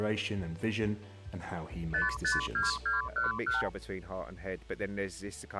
Multi-frequency trunk signalling (R2, with the far end's replies), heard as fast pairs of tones, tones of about 150 ms. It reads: 552211